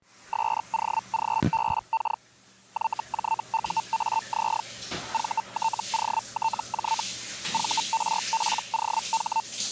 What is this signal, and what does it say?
Hellschreiber (Feld-Hell, 122.5 baud), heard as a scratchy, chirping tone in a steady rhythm, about 900 Hz, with the noise of a restroom. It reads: SOGBK YJUAZ VTOTJ VRPOH